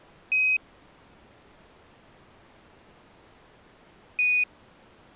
Quindar tones, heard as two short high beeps.